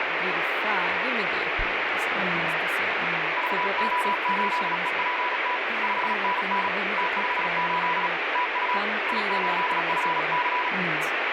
Morse code, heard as a keyed tone, hand-sent with a paddle, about 36 wpm, 990 Hz, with heavy radio static and speech in Swedish. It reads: VO8EPT 5NN T58 TU I8FC